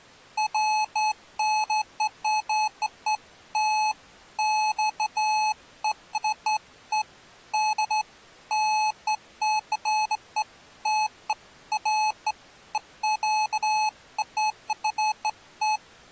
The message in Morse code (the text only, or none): none